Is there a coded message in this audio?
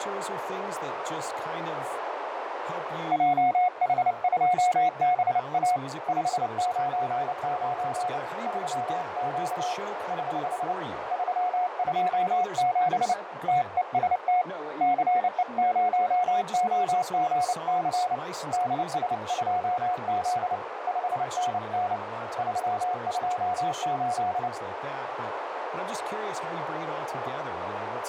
Yes: Morse code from 3.1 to 24.5 s, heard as a keyed tone, hand-sent with a paddle, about 29 wpm, 720 Hz, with heavy radio static, a narrow filter and speech in English. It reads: JH2BA 599 3Q <HH> 327 TEST CE0OGC DS2Z 5NN 328